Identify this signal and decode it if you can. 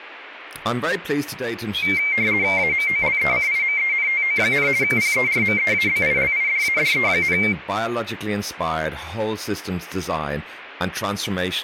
RTTY (50 baud, 170 Hz shift), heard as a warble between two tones, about 2200 Hz centre, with speech in English. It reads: AMOLECIMENTO, PERMEABILIDADE,